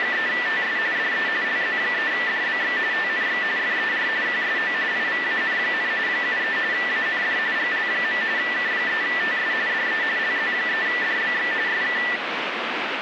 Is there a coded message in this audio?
Yes: RTTY (45.45 baud, 170 Hz shift) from 0.0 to 12.2 s, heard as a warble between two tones, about 1850 Hz centre, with radio static. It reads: … DE LZ3DBX TNX FER QSO IVAN, 73 AND GL. K3TS DE LZ3DBX SK